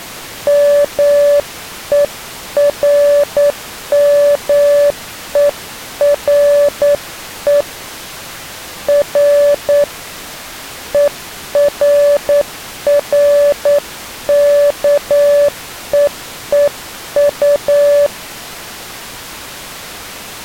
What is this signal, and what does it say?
Morse code, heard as a keyed tone, hand-sent with a straight key, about 9 wpm, 580 Hz. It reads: MERMERE R ERRKEEU